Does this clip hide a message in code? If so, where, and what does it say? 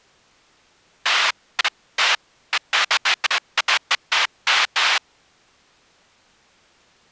No, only bursts of noise.